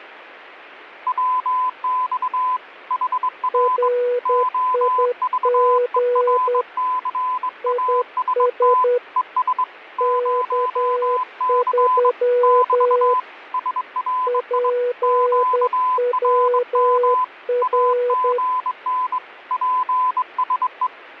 Morse code, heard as two keyed tones, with radio static. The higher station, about 22 wpm, 1010 Hz: WX HR OVERCAST ES 0C <BT> SRI QRM AGN PSE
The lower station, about 10 wpm, 490 Hz: RIG IS K3 PWR